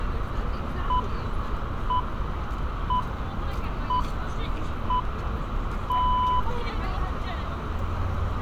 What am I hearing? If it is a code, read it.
Radio time signal (six pips, as the Greenwich Time Signal), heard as pips, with radio static, a narrow filter, room echo and street noise.